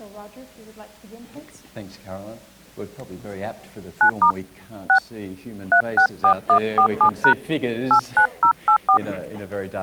DTMF, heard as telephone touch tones, dialled by hand, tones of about 90 ms. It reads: 9* 6 364147# 89084